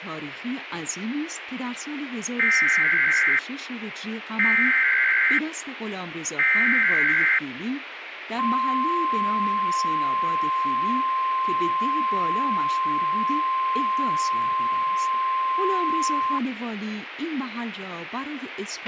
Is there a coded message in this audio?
Yes: Emergency Alert System (SAME) tones (header bursts, then the 1050 Hz attention tone) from 2.4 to 16.4 s, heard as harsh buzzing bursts, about 520.83 baud, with radio hiss, a squelch burst at the end and speech in Persian.